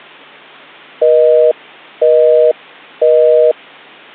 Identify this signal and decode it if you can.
Telephone call progress tone (North American plan), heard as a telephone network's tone, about 480, 620 Hz, 0.5 s on and 0.5 s off. Busy tone.